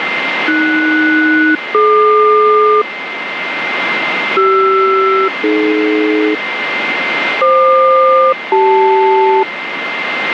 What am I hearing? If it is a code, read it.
Aircraft SELCAL, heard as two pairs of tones, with radio static and a steady whistle near 2090 Hz. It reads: AS-DQ CR-AD FQ-CL